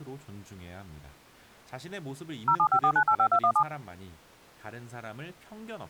DTMF, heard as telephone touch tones, dialled by machine, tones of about 80 ms, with speech in Korean. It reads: 0754985217